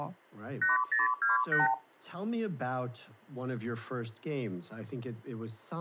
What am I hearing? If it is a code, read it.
Multi-frequency trunk signalling (R2, with the far end's replies), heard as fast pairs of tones, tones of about 150 ms, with speech in English. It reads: 8028